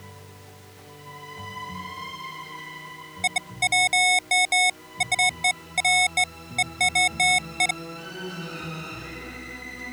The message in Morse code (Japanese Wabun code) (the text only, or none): none